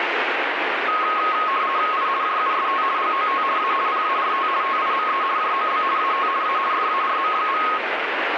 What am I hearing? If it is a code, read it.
RTTY (50 baud, 170 Hz shift), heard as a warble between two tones, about 1170 Hz centre, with radio static. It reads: I JUST GOT A PART TIME JOB AT A FARM.